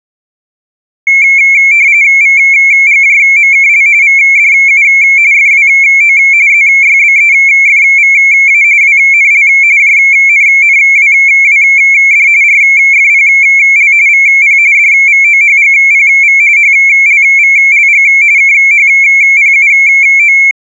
RTTY (45.45 baud, 170 Hz shift), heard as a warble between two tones, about 2250 Hz centre. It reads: VGJMKL VDU FWO ZYBEFVA WNL JNNWWD RFPL VP DVOHGPV HLVLG KHPUO